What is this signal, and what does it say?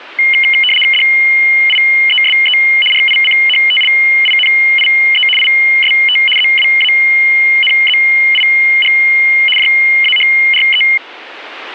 RTTY (75 baud, 850 Hz shift), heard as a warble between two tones, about 2550 Hz centre. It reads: DIESE RICHTLINIE IST ZWANZIG JAHRE